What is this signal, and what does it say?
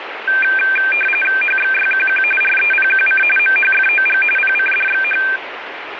RTTY (45.45 baud, 850 Hz shift), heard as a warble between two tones, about 2000 Hz centre, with radio static. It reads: HXYQQ REPQC MHFOG PCDXH